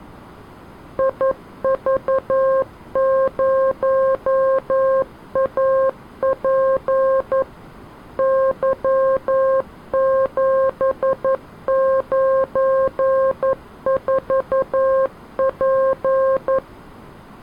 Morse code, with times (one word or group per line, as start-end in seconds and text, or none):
1.0-7.4 IV0AP
8.2-16.6 Y794P